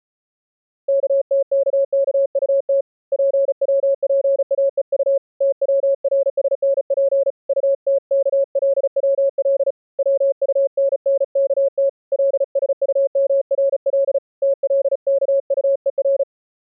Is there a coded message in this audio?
Yes: Morse code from 0.8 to 16.3 s, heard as a keyed tone, hand-sent with a paddle, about 35 wpm, 550 Hz. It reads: KTKKUT PWPAEU TWRSNP UTKLWL WUNNKT LSUMRL TLKUER